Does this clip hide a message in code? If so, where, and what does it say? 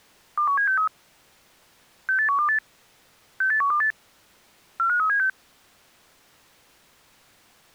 Yes: five-tone selective call (CCIR) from 0.4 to 5.3 s, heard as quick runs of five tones, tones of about 100 ms. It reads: 21763 68128 68128 45376